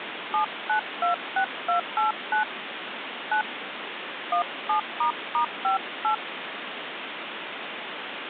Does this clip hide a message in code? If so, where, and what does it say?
Yes: DTMF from 0.3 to 6.1 s, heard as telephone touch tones, dialled by hand, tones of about 110 ms, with phone line noise. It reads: 7926289 9 17**58